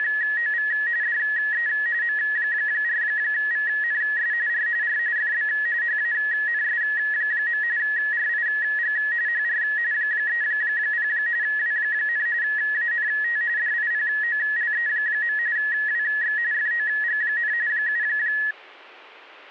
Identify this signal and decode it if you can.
RTTY (45.45 baud, 170 Hz shift), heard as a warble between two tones, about 1800 Hz centre. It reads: … DE M4VNS R R FB HANS. RIG HR 30 W, ANT DIPOLE. WX FOG, 7